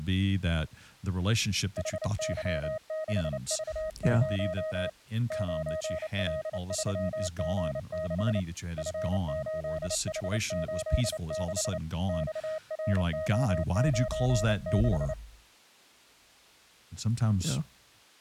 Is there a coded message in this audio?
Yes: Morse code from 1.7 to 15.2 s, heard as a keyed tone, hand-sent with a paddle, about 29 wpm, 630 Hz, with speech in English. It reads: HY6V0 9L3G6 F8H86 XRO96